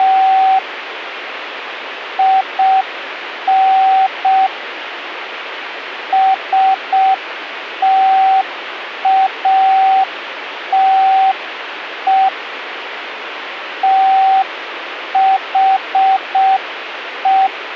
Morse code, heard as a keyed tone, hand-sent with a paddle, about 6 wpm, 770 Hz, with radio static. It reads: … IN STATE THE